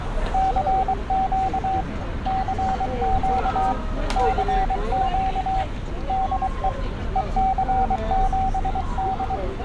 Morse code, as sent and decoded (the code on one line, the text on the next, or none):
-.-. --.- / -.-. --.- / -.-. --.- / -.. . / . -.-. --... -..
CQ CQ CQ DE EC7D